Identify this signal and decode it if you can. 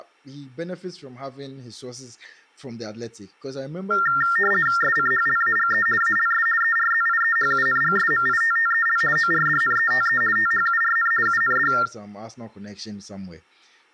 RTTY (50 baud, 450 Hz shift), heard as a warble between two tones, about 1600 Hz centre, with speech in English. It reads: SCHLAGE ALS ERZIEHUNGSMITTEL ORDNETE THURN UND